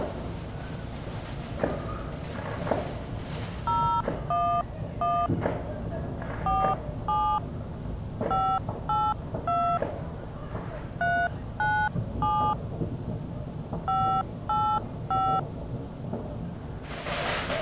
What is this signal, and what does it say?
DTMF, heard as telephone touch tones, dialled by hand, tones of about 280 ms. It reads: 011 47 582 397 585